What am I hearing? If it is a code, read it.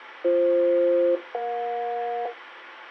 Aircraft SELCAL, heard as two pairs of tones. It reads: BF-EJ